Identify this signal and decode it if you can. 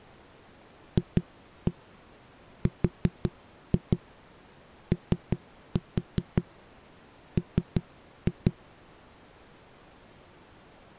Tap code, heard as knocks on a wall, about 5 knocks a second. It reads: FROM